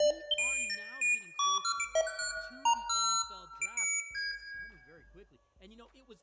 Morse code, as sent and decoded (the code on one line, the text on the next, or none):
none